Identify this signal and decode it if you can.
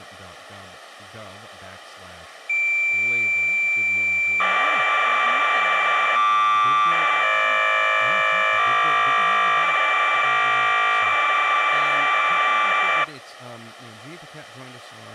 Cassette data (Kansas City type), 1200 baud, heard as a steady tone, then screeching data, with speech in English.